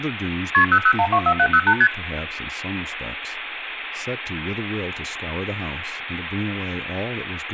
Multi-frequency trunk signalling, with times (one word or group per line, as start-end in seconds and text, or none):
0.5-0.6 KP
0.7-1.7 00124708
1.8-1.9 ST